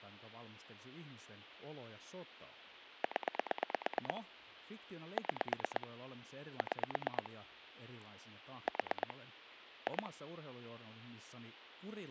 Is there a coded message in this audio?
Yes: pulse dialling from 3.0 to 10.1 s, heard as clicks on a phone line, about 8 pulses a second, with speech in Finnish. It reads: 0 6 6 4 2